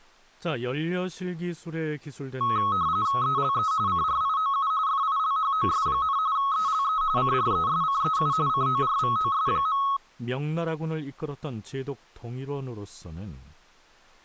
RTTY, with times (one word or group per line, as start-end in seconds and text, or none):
3.2-3.7 ELE
3.9-4.7 CRIOU
4.9-6.2 FILHOS,
6.4-7.0 ELE
7.2-8.3 CRESCEU
8.5-9.8 CORVOS.